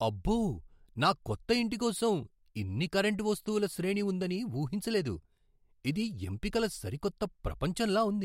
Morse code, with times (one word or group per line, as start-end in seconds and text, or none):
none